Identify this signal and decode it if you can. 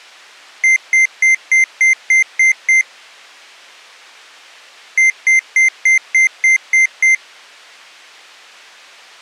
Beep code, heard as beeps from a small speaker, played twice, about 2100 Hz. 8 short. In AMI BIOS tables: display memory failure; in Dell tables: LCD failure.